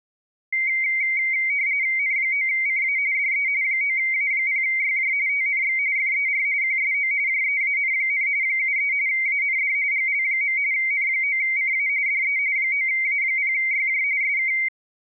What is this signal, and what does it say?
RTTY (45.45 baud, 170 Hz shift), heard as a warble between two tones, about 2150 Hz centre. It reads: N9CA DE 9A0YJ TNX FER QSO JEAN, 73 AND GL. N9CA DE 9A0YJ SK